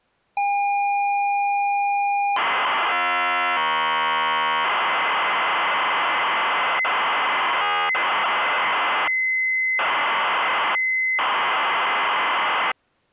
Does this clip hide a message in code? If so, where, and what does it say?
Yes: ZX Spectrum tape loading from 0.4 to 12.7 s, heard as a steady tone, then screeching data.